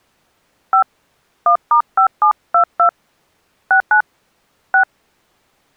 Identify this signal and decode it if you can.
DTMF, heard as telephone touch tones, dialled by hand, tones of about 100 ms. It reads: 5 1*5722 69 6